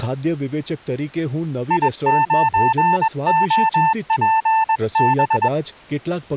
Morse code, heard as a keyed tone, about 21 wpm, 890 Hz, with speech in Gujarati. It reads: I9OPB